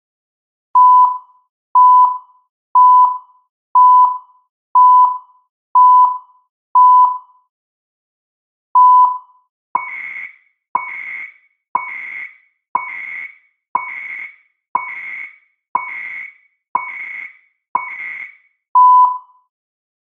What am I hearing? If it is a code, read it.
Radio time signal (CHU, Canada), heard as beeps and data bursts, one a second, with room echo.